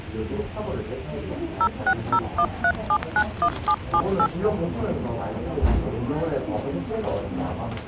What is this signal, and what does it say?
DTMF, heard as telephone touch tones, dialled by machine, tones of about 70 ms, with the noise of a crowd indoors. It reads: 06013791778